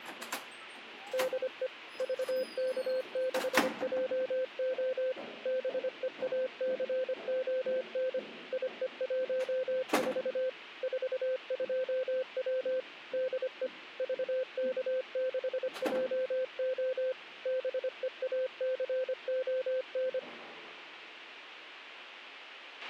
Morse code, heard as a keyed tone, machine-sent, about 25 wpm, 520 Hz, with a squelch burst at the end. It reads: DE VK6JO BEACON IE14 42W DE VK6JO BEACON